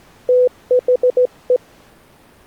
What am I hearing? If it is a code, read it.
Morse code, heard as a keyed tone, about 17 wpm, 500 Hz. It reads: THE